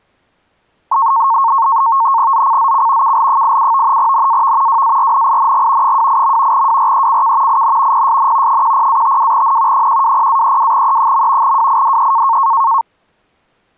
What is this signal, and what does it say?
NAVTEX (SITOR-B), 100 baud, 170 Hz shift, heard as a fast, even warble, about 1000 Hz centre. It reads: ZCZC KL87 NAV WARNING 28. WRECK IN PSN 10-52N 120-32E. WIDE